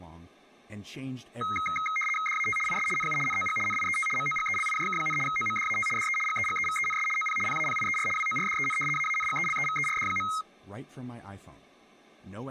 RTTY (75 baud, 850 Hz shift), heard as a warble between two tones, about 1700 Hz centre, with speech in Danish. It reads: DAT IS NU NOG NIET MOGELIJK, OMDAT DE GEGEVENS OP PAPIER WORDEN AANGELEVERD.